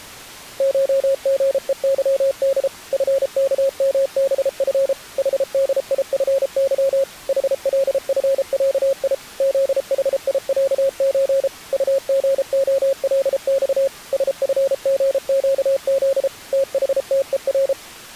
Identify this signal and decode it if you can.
Morse code (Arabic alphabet), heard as a keyed tone, machine-sent, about 33 wpm, 540 Hz. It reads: شغءظد فكمبف حديفظ حلفعي ذحيعز طغخلص سفغقذ تحتءر